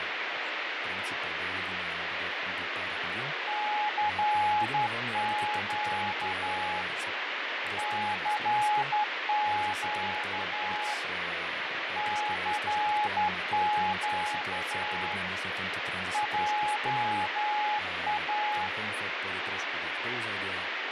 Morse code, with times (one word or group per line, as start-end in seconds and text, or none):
3.5-6.8 CQ
7.8-10.9 CQ
12.0-15.1 CQ
16.1-18.7 JA